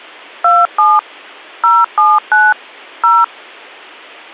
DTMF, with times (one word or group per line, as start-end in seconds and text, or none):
0.4-1.0 27
1.6-2.5 079
3.0-3.2 0